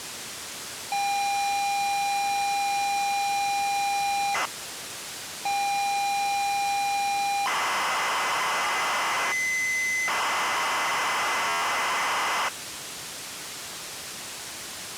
ZX Spectrum tape loading, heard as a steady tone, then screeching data, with tape hiss.